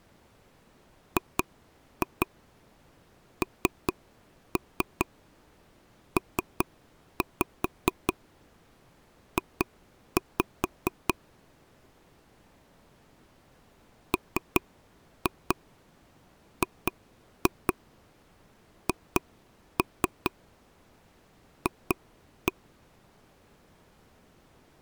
Tap code, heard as taps on a table, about 4 knocks a second. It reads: GNPJ MGHF